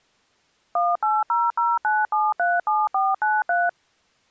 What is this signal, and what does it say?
DTMF, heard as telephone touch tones, dialled by machine, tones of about 200 ms. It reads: 18009737493